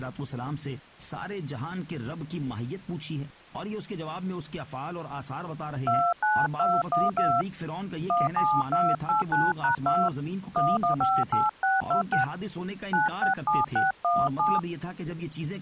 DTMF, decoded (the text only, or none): 29212 17289#2 1158626 967617